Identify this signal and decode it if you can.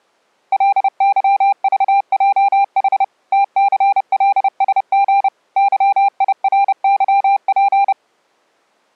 Morse code, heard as a keyed tone, machine-sent, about 30 wpm, 800 Hz. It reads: LYVJH TCLSG YIRYP